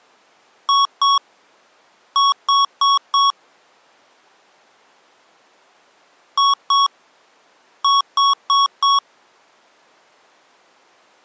Beep code, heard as beeps from a small speaker, played twice, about 1110 Hz. 2-4.